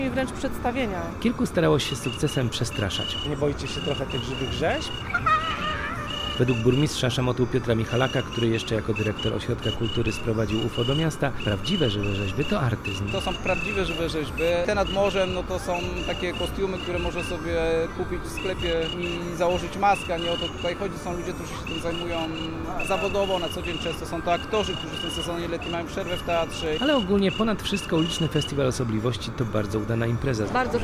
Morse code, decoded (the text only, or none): SAYID DISAPPEARS HER HOWEVER